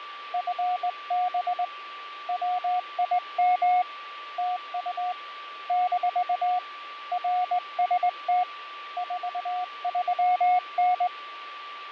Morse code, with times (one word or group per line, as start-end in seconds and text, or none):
0.3-1.6 FB
2.3-3.8 WIM
4.4-5.1 TU
5.7-6.6 -
7.1-8.4 RST
9.0-11.1 43N